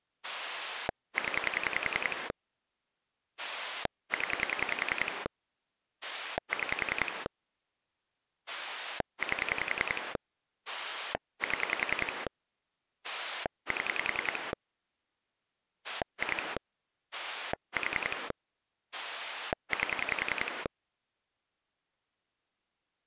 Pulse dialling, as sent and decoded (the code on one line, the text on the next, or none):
10 / 10 / 6 / 8 / 7 / 7 / 2 / 4 / 8
0 0 6 8 7 7 2 4 8